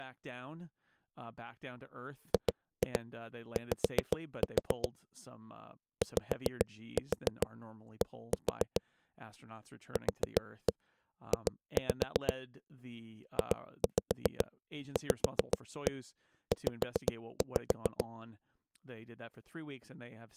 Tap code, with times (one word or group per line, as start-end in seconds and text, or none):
2.3-4.9 GY
6.0-8.8 YD
10.0-12.3 QJ
13.4-18.0 JVZ